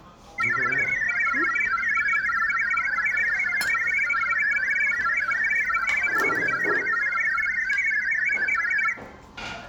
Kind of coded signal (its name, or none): multi-tone FSK (Olivia or MFSK type)